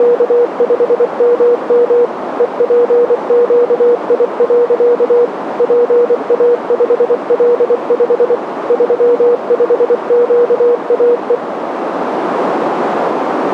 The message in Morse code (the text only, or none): … EPQI. PA5L5 35QAE